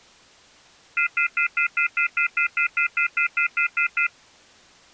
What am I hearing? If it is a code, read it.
Telephone call progress tone (North American plan), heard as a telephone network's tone, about 1400, 2050, 2450, 2600 Hz, 0.1 s on and 0.1 s off. Off-hook warning tone.